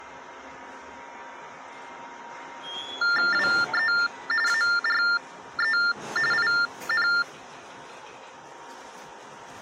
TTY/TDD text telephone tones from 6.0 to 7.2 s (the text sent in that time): IN